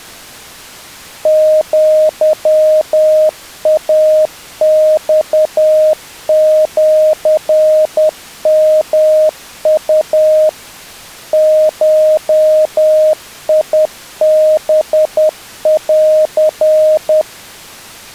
Morse code (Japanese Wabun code), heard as a keyed tone, machine-sent, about 10 wpm, 620 Hz. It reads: アイマシヨウ ゴハン